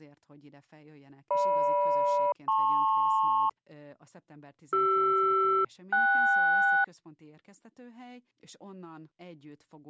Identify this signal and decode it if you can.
Aircraft SELCAL, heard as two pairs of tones, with speech in Hungarian. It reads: GM-LP CR-KS